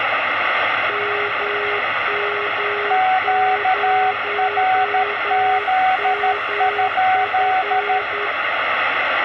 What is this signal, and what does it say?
Morse code, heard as two keyed tones, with radio static, room echo and the noise of a subway station. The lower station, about 10 wpm, 410 Hz: MM0MF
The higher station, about 13 wpm, 750 Hz: QRZ?